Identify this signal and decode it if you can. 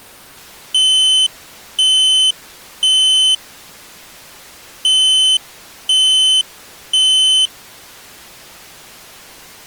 Alarm pattern, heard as an alarm's beeps, played twice, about 3050 Hz. Temporal three. Smoke or fire, evacuate.